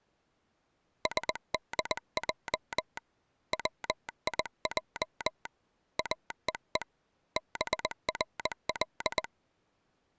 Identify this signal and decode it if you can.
Morse code, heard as a telegraph sounder, hand-sent with a paddle, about 20 wpm. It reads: SDJ WIJ AEE BRL